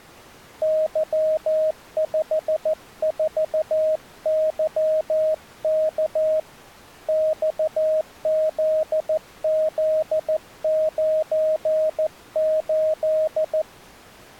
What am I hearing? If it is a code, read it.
Morse code, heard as a keyed tone, hand-sent with a paddle, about 14 wpm, 630 Hz. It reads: Y54YK XZZ98